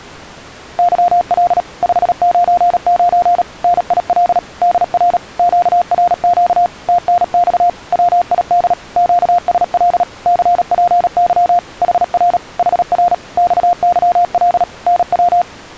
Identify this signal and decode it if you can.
Morse code, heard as a keyed tone, machine-sent, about 37 wpm, 700 Hz. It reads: YL 599 NIL DR QRQ TNX WID QSL CPY HR HR XYL NW